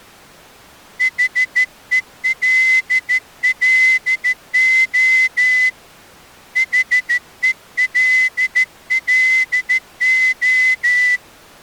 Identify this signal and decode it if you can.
Morse code, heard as a whistle, hand-sent with a straight key, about 13 wpm. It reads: HELLO HELLO